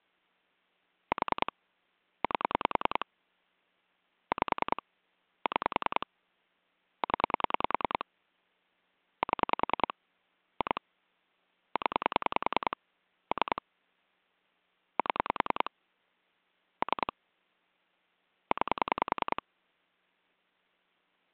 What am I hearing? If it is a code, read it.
Pulse dialling, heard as clicks on a phone line, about 10 pulses a second. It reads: 4 8 5 6 0 7 2 0 3 7 3 9